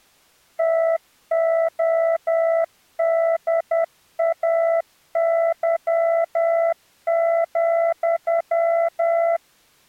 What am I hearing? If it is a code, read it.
Morse code, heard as a keyed tone, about 10 wpm, 660 Hz. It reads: TODAY,